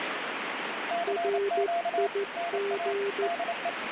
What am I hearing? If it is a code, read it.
Morse code, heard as two keyed tones, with radio static. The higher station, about 28 wpm, 690 Hz: CQ NA DE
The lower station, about 14 wpm, 400 Hz: RIG